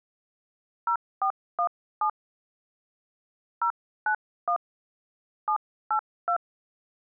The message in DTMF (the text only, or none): 0417 091 782